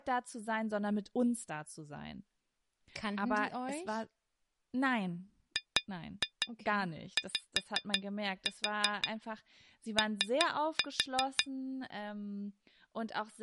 Tap code, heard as taps on glass, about 5 knocks a second, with speech in German. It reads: GYO